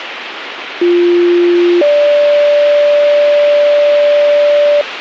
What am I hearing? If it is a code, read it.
Two-tone page, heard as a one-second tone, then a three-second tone, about 350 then 580 Hz, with radio hiss.